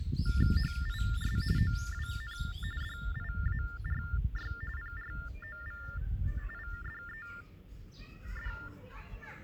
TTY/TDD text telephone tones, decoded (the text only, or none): HIS OWN DIARY PROVIDED